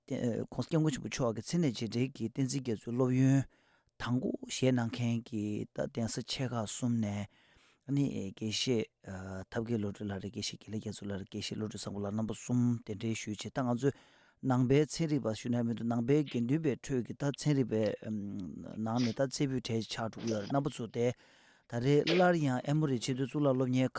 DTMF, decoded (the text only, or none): none